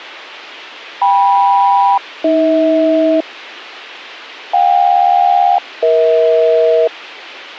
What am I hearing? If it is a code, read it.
Aircraft SELCAL, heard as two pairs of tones. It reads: KM-AH JK-EH